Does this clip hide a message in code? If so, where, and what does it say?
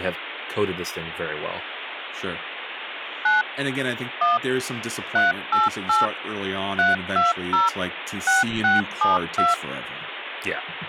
Yes: DTMF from 3.3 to 9.5 s, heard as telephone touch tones, dialled by machine, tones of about 160 ms, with phone line noise and speech in English. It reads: 9 1 388 320 6672